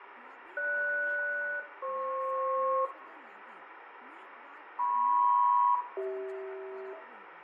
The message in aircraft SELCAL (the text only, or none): GS-FP MP-CH